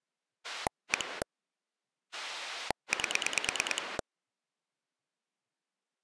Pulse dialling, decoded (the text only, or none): 1 8